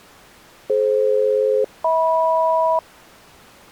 Aircraft SELCAL, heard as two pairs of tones. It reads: DF-HM